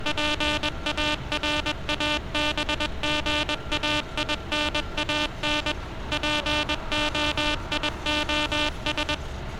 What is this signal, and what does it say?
Morse code (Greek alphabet), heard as a buzzer, machine-sent, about 21 wpm, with street noise. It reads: ΠΑΡΑΒΓΑΙΝΑΝ ΠΟΙΟΣ